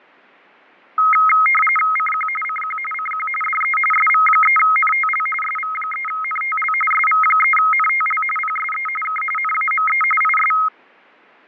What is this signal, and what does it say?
RTTY (45.45 baud, 850 Hz shift), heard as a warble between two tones, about 1700 Hz centre, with fading. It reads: CQ CQ CQ DE SV3NTL SV3NTL SV3NTL PSE K NAME IS